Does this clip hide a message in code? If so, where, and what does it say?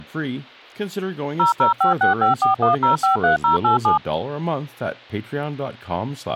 Yes: DTMF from 1.4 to 4.0 s, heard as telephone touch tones, dialled by machine, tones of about 130 ms, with speech in English. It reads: 0056541053087